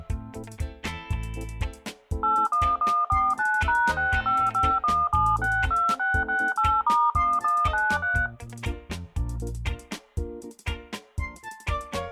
DTMF, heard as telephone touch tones, dialled by machine, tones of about 240 ms. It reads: 81149#6551762668*1193